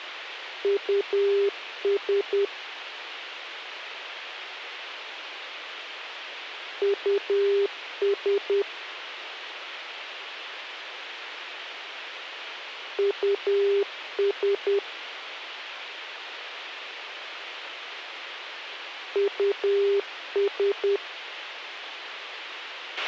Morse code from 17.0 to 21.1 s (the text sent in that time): US